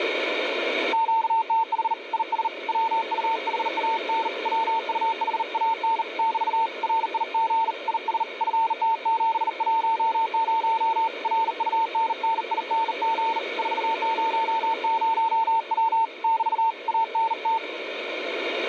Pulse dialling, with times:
none

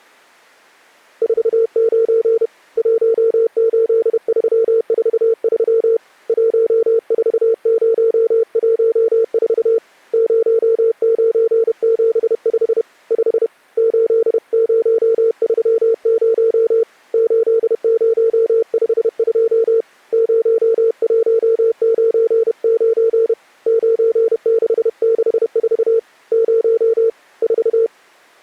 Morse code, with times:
1.2-2.5 49
2.8-6.0 18343
6.3-9.8 14014
10.1-12.8 0975
13.1-13.5 5
13.8-16.8 8030
17.1-19.8 8052
20.1-23.3 0199
23.7-26.0 9664
26.3-27.1 0
27.4-27.9 4

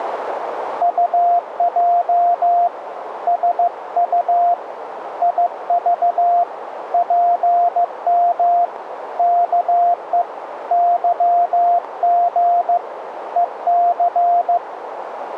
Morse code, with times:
0.8-2.7 UJ
3.3-4.5 SU
5.2-6.4 IV
6.9-8.6 PM
9.2-10.2 KE
10.7-12.8 YG
13.4-14.6 EC

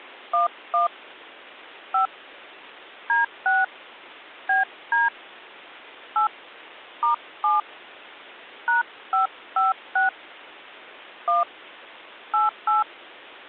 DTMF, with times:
0.3-0.9 11
1.9-2.1 5
3.1-3.6 D6
4.5-5.1 BD
6.2-6.3 8
7.0-7.6 *7
8.7-10.1 #556
11.3-11.4 1
12.3-12.8 88

